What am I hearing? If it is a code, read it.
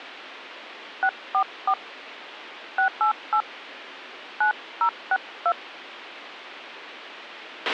DTMF, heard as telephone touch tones, dialled by hand, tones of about 80 ms, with a squelch burst at the end. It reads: 644 688 9062